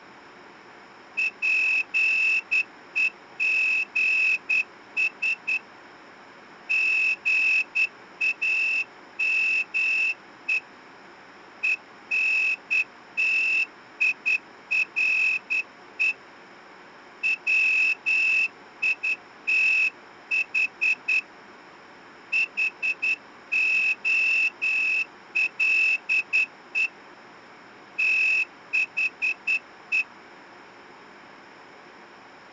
Morse code, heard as a whistle, hand-sent with a straight key, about 10 wpm. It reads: PEGS GAME ENTIRE WITH HOLE THE